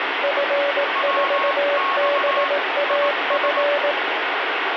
Morse code, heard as two keyed tones, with radio static. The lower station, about 18 wpm, 570 Hz: F4BAF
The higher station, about 19 wpm, 1090 Hz: WX IS